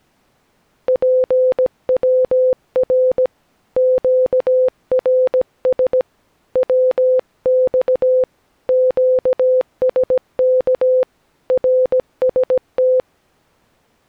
Morse code, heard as a keyed tone, hand-sent with a paddle, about 17 wpm, 510 Hz. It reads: PWR QRS WX QSK RST